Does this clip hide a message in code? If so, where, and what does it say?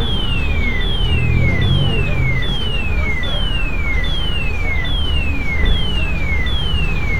No, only a tone that sweeps in pitch again and again, with radio static and street noise.